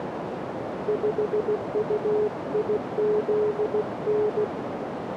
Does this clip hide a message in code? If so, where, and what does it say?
Yes: Morse code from 0.8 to 4.5 s, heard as a keyed tone, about 16 wpm, 420 Hz, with radio static and a narrow filter. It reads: 5UIZN